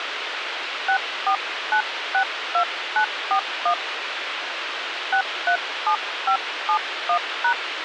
DTMF, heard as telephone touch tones, dialled by hand, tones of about 90 ms, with radio hiss. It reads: 64962941 637571#